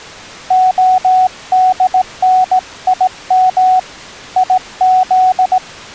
Morse code (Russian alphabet), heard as a keyed tone, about 17 wpm, 740 Hz. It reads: ОДНИМ ИЗ